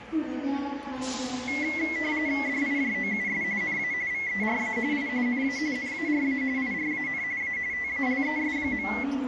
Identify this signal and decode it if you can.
RTTY (45.45 baud, 170 Hz shift), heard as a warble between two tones, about 2050 Hz centre, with radio static and the noise of a crowd indoors. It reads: DIJOUS NA VERA I NA NARA IRAN A TALES.